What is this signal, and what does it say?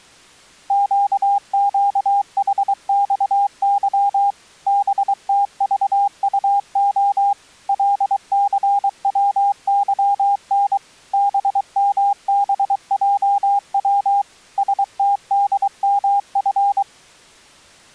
Morse code, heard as a keyed tone, machine-sent, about 23 wpm, 810 Hz. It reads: QQHXY BTVUO LCWYN BMBJW STDMF